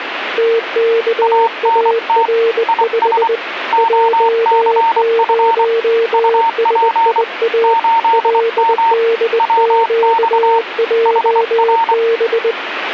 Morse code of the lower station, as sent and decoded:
- -.- .- .-. ..... / .--- ----- ... .. .- / .-.. -.. --.- .--- -...
TKAR5 J0SIA LDQJB

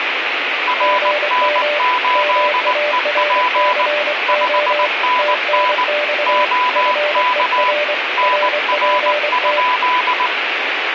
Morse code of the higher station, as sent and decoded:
.-. -. ---.. . .--. / ..... -. -. / --- -.- / -. .-. ..--..
RN8EP 5NN OK NR?

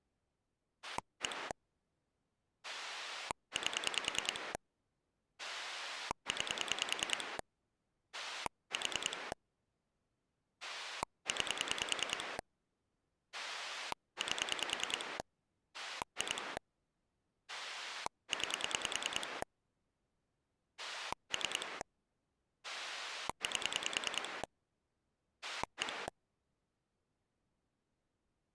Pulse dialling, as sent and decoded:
1 / 8 / 9 / 4 / 9 / 8 / 2 / 9 / 3 / 8 / 1
1 8 9 4 9 8 2 9 3 8 1

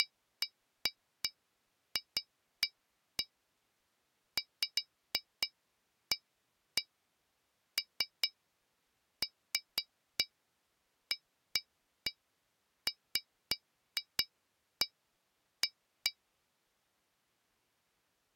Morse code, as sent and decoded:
none

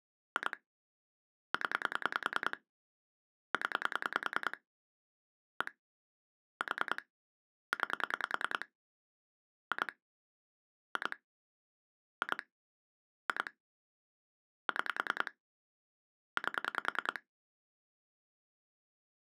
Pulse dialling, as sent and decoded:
2 / 10 / 10 / 1 / 4 / 9 / 2 / 2 / 2 / 2 / 6 / 8
2 0 0 1 4 9 2 2 2 2 6 8

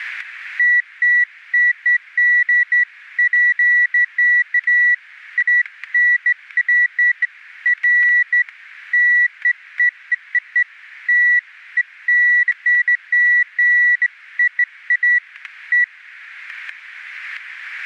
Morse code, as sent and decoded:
none

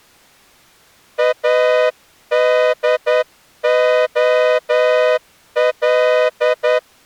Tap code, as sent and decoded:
none

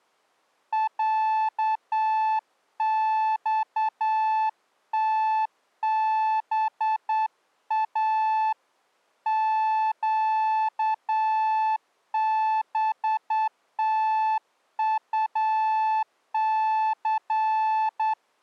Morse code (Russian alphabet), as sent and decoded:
.-.- -..- - -... .- / --.- -... - ..- -.-.
ЯЬТБА ЩБТУЦ

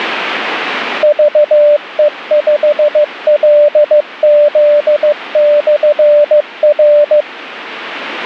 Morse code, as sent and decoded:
...- . ..... .-.. --.. -..-. .-.
VE5LZ/R

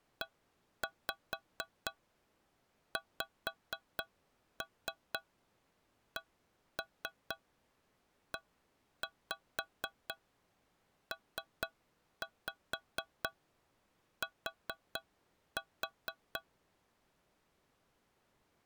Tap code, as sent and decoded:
1-5 5-3 1-3 1-5 3-5 4-4
EXCEPT

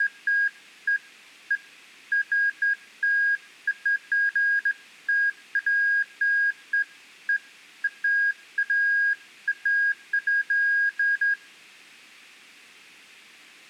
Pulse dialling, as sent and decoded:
none

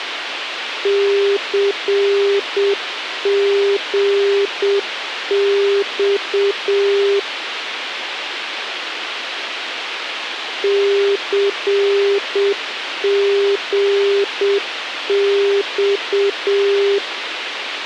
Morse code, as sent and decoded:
-.-. --. -..- / -.-. --. -..-
CGX CGX

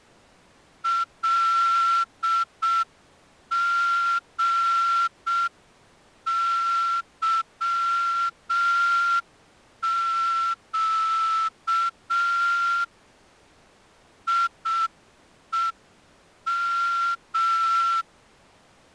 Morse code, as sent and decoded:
.-.. --. -.-- --.- / .. . --
LGYQ IEM

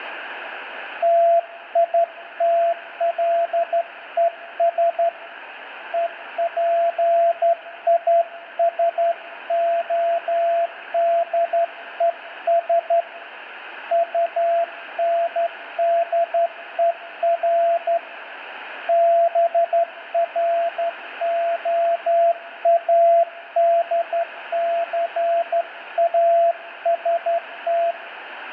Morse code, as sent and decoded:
- .. - .-.. . ... / . .--. .. ... --- -.. . ... / ..- -. -.. . .-. / -... .-. --- .- -.. -.-. .- ... -
TITLES EPISODES UNDER BROADCAST

